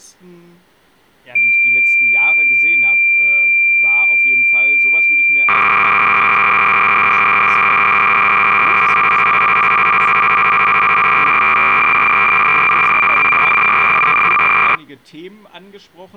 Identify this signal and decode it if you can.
Cassette data (Kansas City type), 300 baud, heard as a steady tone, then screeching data, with speech in German.